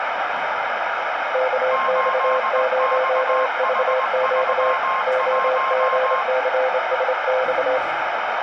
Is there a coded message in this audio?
Yes: Morse code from 1.3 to 7.8 s, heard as two keyed tones, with radio static and the noise of a cafe. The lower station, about 27 wpm, 520 Hz: KX0VQ OGCSX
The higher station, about 20 wpm, 1060 Hz: 8XH31